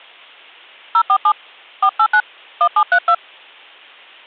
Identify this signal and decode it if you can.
DTMF, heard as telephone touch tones, dialled by hand, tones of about 70 ms. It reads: 047 489 1732